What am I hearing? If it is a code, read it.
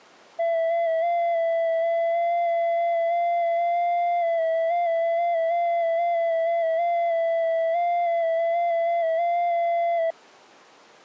FT8 (one signal), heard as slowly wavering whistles, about 6.25 baud.